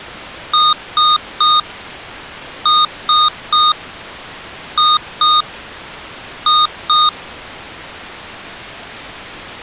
Beep code, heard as beeps from a small speaker, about 1230 Hz. 3-3-2-2.